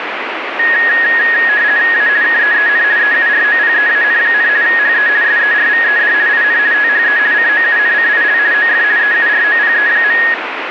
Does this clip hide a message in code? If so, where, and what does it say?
Yes: RTTY (50 baud, 170 Hz shift) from 0.6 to 10.3 s, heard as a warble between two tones, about 1750 Hz centre, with radio static. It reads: A KEEN EUROPEAN, HE SERVED IN THE COUNCIL OF EUROPE.